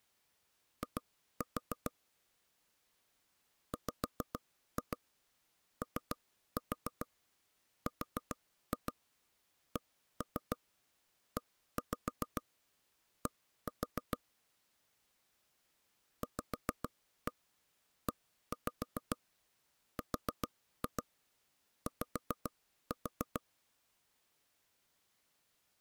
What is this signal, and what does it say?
Tap code, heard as knocks on wood, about 7 knocks a second. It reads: I WORKED VERY